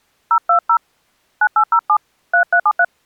DTMF, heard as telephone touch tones, dialled by hand, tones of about 70 ms. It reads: 020 9807 3373